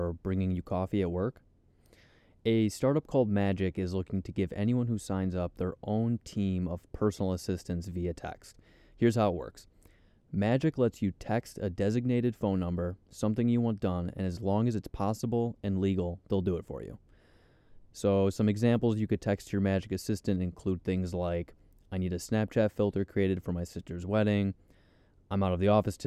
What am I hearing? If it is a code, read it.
Speech in English. There is no code.